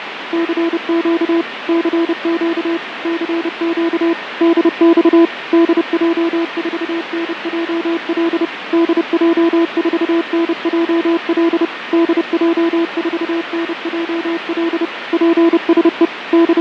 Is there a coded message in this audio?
Yes: Morse code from 0.3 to 16.6 s, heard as a keyed tone, machine-sent, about 30 wpm, 340 Hz, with radio static, fading and a weaker station near 1830 Hz. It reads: CQ CQ CQ DX DJ4NJL DJ4NJL DJ4NJL PSE …